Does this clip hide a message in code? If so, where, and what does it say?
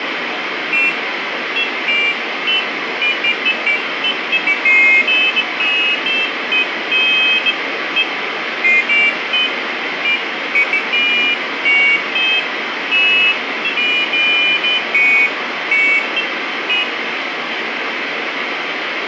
No, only pairs of high tones at irregular times, with radio static and room echo.